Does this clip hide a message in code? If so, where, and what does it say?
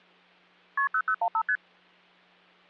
Yes: multi-frequency trunk signalling (R1, as on North American trunks) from 0.8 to 1.6 s, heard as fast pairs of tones, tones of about 70 ms, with hum. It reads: KP 0015 ST